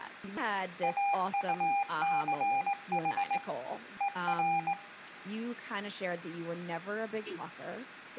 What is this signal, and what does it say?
Morse code, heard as a keyed tone, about 19 wpm, 800 Hz, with room echo and speech in English. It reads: AUCH ER